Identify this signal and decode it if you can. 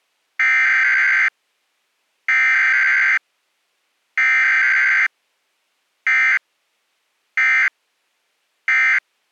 Emergency Alert System (SAME) tones (header bursts, then end-of-message bursts), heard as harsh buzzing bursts, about 520.83 baud.